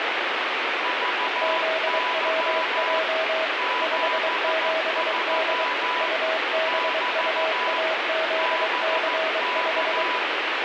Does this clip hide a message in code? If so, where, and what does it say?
Yes: Morse code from 0.8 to 10.3 s, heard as two keyed tones, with heavy radio static. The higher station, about 14 wpm, 990 Hz: VY 73 <BT> BK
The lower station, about 23 wpm, 640 Hz: ZWJ 57D UBUAZC5